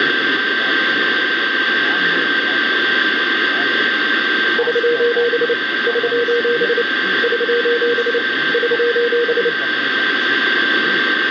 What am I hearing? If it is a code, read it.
Morse code, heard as a keyed tone, hand-sent with a paddle, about 29 wpm, 480 Hz, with radio static and a steady whistle near 1570 Hz. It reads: <SOS> <SOS> <SOS> <SOS>